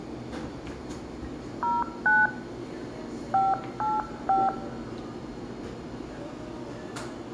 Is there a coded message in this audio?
Yes: DTMF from 1.6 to 4.5 s, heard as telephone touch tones, dialled by hand, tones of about 200 ms, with the noise of a cafe. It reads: 09 585